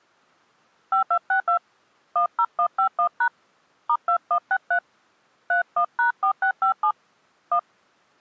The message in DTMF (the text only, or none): 5262 10151# *2163 31#4657 1